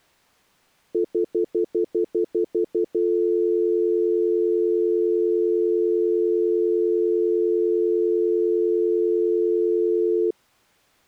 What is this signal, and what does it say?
Telephone call progress tone (North American plan), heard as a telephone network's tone, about 350, 440 Hz, 0.1 s on and 0.1 s off. Stutter dial tone.